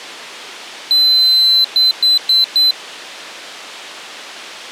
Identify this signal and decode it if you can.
Beep code, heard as a piezo beeper, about 4050 Hz. 1 long, 4 short.